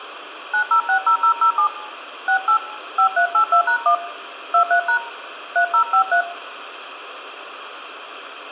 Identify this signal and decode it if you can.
DTMF, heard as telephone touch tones, dialled by hand, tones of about 90 ms, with phone line noise and room echo. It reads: 9060007 68 5382#1 23# 3053